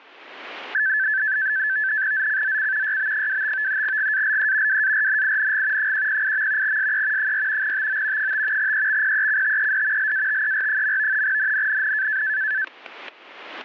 NAVTEX (SITOR-B), 100 baud, 170 Hz shift, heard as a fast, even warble, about 1650 Hz centre, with static crashes. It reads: ZCZC YB25 GALE WARNING 108. SE 4 TO 5 EXPECTED LATER. NNNN